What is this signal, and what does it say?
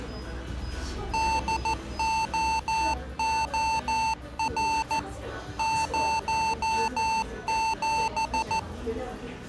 Morse code, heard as electronic beeps, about 14 wpm, 890 Hz, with the noise of a cafe. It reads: DOOR 07